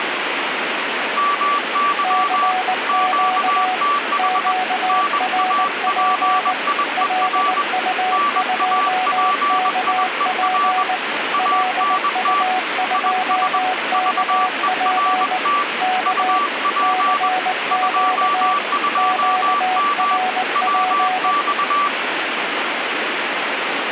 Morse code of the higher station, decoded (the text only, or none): MY QTH NAPIER NAPIER ANT IS VERT UP 22M WX